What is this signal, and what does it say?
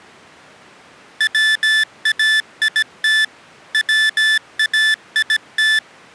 Morse code, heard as electronic beeps, machine-sent, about 17 wpm, 1750 Hz. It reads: WAIT WAIT